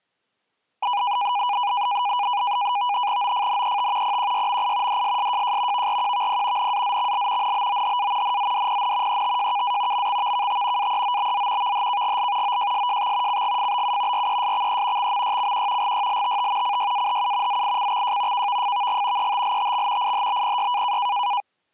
NAVTEX (SITOR-B), 100 baud, 170 Hz shift, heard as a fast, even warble, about 900 Hz centre. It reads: OFNET PQYMI DSSJJ VRQVP NAZXL NBOHA NZDPN ETJKA MXVKT AEOBZ VHKGL OJSJX CGFBU RESXE XMYCQ GYLTT CYAHU ZICXJ KVFVG ETLTX IHBPY